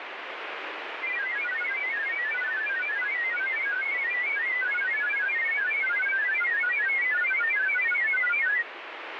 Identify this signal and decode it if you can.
Multi-tone FSK (Olivia or MFSK type), about 1000 Hz wide, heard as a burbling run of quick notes, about 31.25 baud, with radio static.